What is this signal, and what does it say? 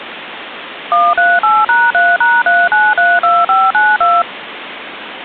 DTMF, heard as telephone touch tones, dialled by machine, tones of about 220 ms, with phone line noise. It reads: 138#3#3932592